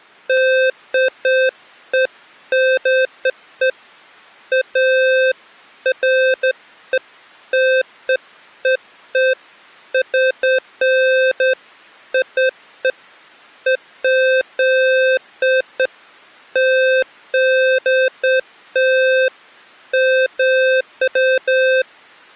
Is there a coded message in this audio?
No, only beeps of irregular length.